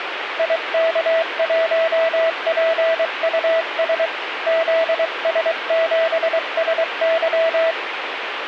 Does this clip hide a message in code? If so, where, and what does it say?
Yes: Morse code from 0.3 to 7.8 s, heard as a keyed tone, hand-sent with a paddle, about 23 wpm, 660 Hz, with radio static. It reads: IK1PUS ZS7SY